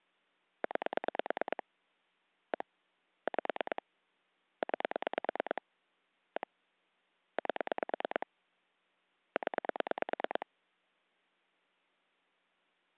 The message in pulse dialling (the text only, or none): 9 1 5 9 1 8 0